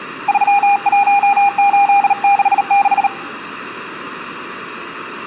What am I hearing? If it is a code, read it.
Morse code, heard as a keyed tone, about 38 wpm, 800 Hz, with room echo. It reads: 31866